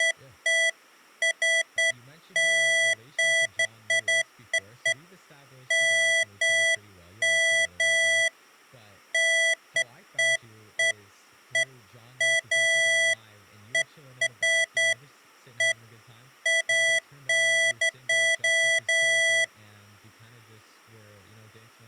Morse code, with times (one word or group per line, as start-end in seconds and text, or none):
none